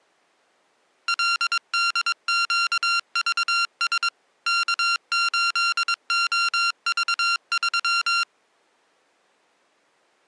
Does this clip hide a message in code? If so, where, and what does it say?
Yes: Morse code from 1.0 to 8.3 s, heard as electronic beeps, machine-sent, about 22 wpm, 1380 Hz. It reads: LDQVS K8OV3